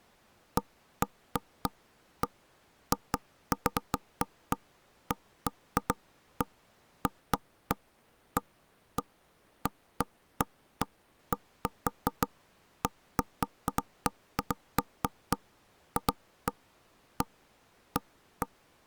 Irregular knocks on wood. There is no code.